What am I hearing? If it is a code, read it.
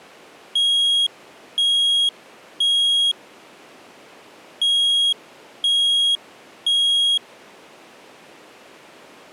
Alarm pattern, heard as an alarm's beeps, played twice, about 3300 Hz. Temporal three. Smoke or fire, evacuate.